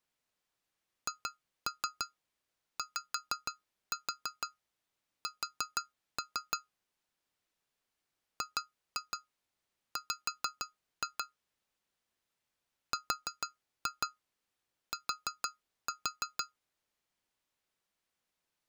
Tap code, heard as taps on glass, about 6 knocks a second. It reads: HYS GW RT